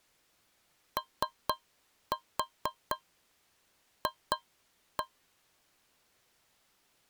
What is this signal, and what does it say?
Tap code, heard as taps on a metal pipe, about 4 knocks a second. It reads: OF